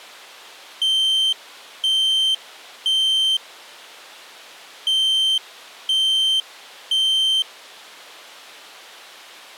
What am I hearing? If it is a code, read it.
Alarm pattern, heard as an alarm's beeps, played twice, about 3100 Hz. Temporal three. Smoke or fire, evacuate.